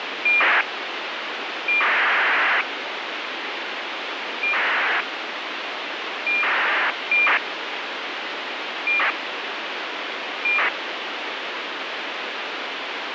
ACARS aircraft data, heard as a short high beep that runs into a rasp, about 2400 baud, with radio hiss.